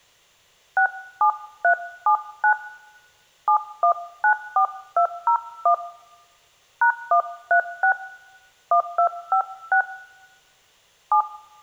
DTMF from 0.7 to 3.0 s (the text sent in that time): 67379